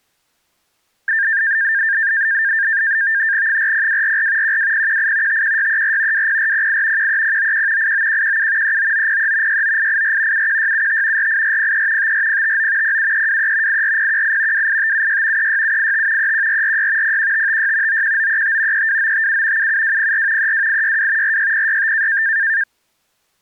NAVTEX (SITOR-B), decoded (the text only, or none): 40244 12018 51634 20408 13091 89117 39903 69884 71675 48403 54059 07323 84018 28576 36785 31446 01556 91935 32957 77204 32862 46065